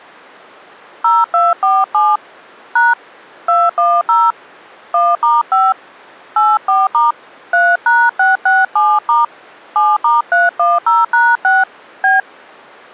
DTMF, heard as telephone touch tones, dialled by hand, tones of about 200 ms. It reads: 0247 # 210 1*5 84* 3#667* 7*310#6 B